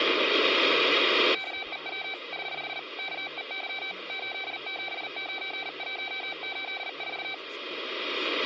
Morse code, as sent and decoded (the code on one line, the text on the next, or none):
-.- . .-- / ........ / -.- . -.-- / ---.. --... ----. .---- ---.. ....-
KEW <HH> KEY 879184